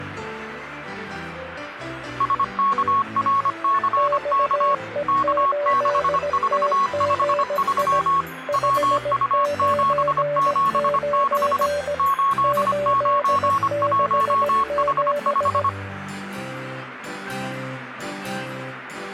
Morse code, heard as two keyed tones, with radio static. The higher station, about 25 wpm, 1100 Hz: SKRCK K6453 WU776 891H5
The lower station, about 17 wpm, 580 Hz: XE8TGI 599 867